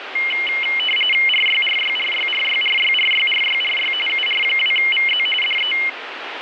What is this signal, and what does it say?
RTTY (45.45 baud, 850 Hz shift), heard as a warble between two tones, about 2550 Hz centre, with radio static. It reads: RYRYRYRYRYRYRYRY UR2VZ DE